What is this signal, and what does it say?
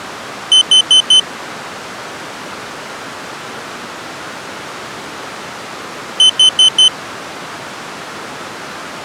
Alarm pattern, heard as an alarm's beeps, played twice, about 3050 Hz. Temporal four. Carbon monoxide.